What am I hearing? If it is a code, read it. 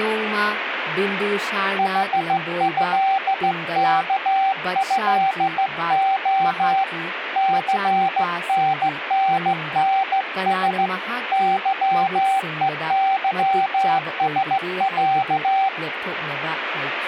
Morse code (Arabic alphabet), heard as a keyed tone, hand-sent with a straight key, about 15 wpm, 770 Hz, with radio static and speech in Manipuri. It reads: حهكهخ ثنننس ظءظسع